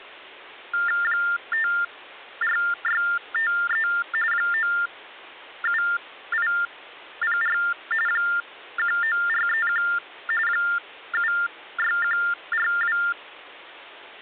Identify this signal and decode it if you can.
TTY/TDD text telephone tones (45.45 baud Baudot), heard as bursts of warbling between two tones, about 400 Hz shift, 1600 Hz centre. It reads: 54653 97804 19431 76142